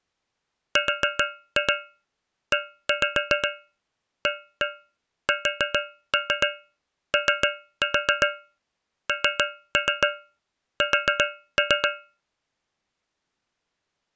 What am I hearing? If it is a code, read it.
Tap code, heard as taps on a metal pipe, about 7 knocks a second. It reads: REASONS